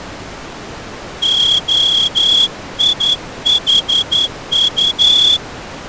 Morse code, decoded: OIHU

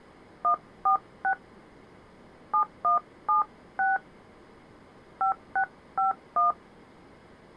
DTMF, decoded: 146 7176 5651

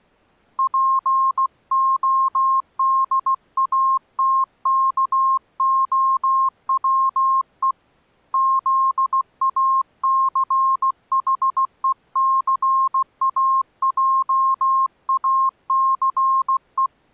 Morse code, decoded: PODATKOWE ZACHECAJACE

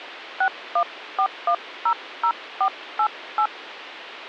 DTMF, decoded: 614100488

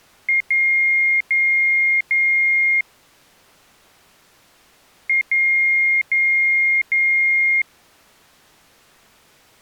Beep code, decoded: 1 short, 3 long

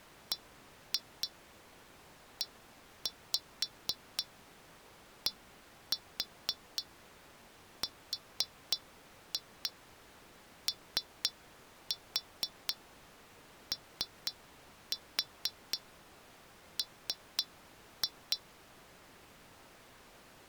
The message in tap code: BEDROOM

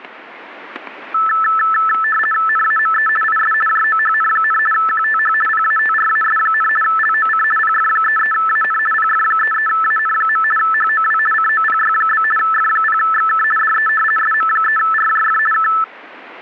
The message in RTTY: NAME IS JOHN, QTH PATRAS, LOC PF33AN PF33AN. HOW COPY? F0XK DE SM3RJF K

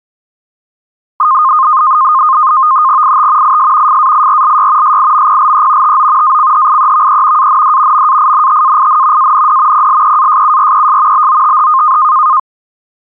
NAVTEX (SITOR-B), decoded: IT IS FAIRLY SIMPLE TO ACHIEVE AND MAINTAIN AND PLEASURES BOTH

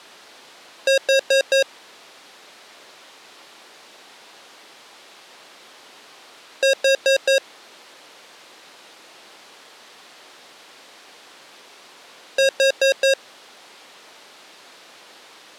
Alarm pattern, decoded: temporal four

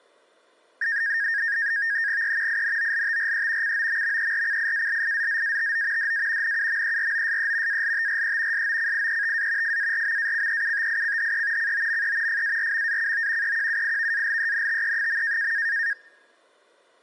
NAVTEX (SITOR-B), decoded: E INOLTRE COMMERCIALIZZATO DA NUMEROSE ALTRE SOCIETA FARMACEUTICHE COME FARMACO EQUIVALENTE.

